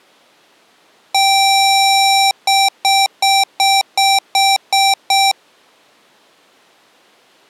Beep code, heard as beeps from a small speaker, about 780 Hz. 1 long, 8 short. In AMI BIOS tables: display or retrace test failure.